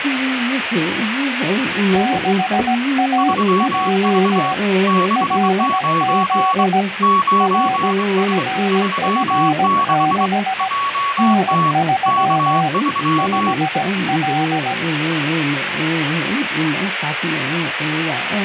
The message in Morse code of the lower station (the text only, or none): 6AJ LZ RFF6 N3 5L